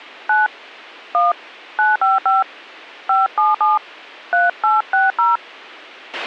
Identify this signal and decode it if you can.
DTMF, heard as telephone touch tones, dialled by hand, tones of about 170 ms, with a squelch burst at the end. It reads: 9 1 955 577 3860